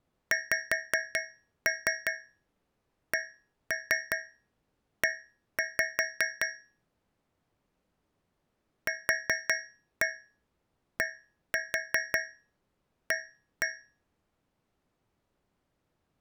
Tap code, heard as taps on a metal pipe, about 5 knocks a second. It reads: XCE QDA